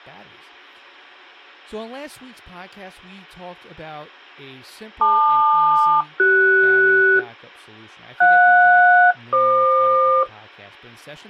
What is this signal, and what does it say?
Aircraft SELCAL, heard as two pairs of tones, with speech in English. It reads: LQ-CS JS-FQ